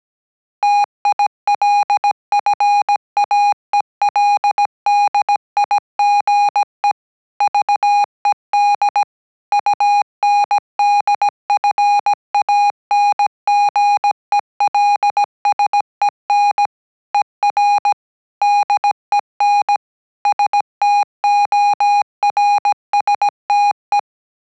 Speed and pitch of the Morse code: 17 wpm, 820 Hz

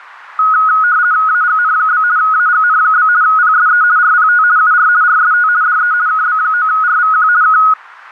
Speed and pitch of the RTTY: 50 baud, 170 Hz shift, 1360 Hz centre

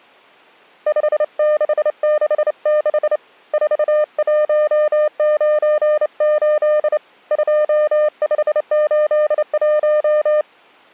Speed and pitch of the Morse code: 28 wpm, 600 Hz

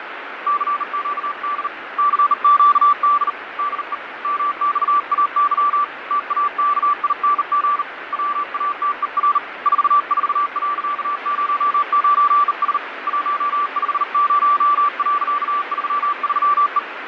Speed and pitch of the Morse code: 39 wpm, 1160 Hz

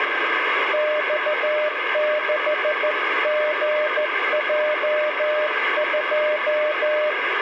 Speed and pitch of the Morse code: 14 wpm, 600 Hz

